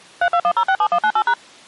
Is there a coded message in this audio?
Yes: DTMF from 0.2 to 1.3 s, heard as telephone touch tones, dialled by machine, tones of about 70 ms. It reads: 321067198#